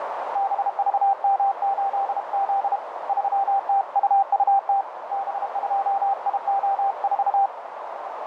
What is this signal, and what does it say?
Morse code, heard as a keyed tone, hand-sent with a paddle, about 32 wpm, 790 Hz, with heavy radio static and a narrow filter. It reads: BVM8Z 3TUUT B2IO4